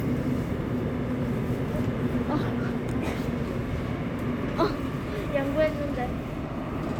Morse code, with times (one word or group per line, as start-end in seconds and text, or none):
none